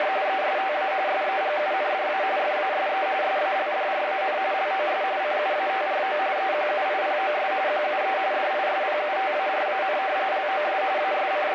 RTTY (45.45 baud, 170 Hz shift), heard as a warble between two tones, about 680 Hz centre, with radio static. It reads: … ESTA SEGUNDA FASE SALDRAN LOS CUATRO EQUIPOS QUE DISPUTARAN LOS …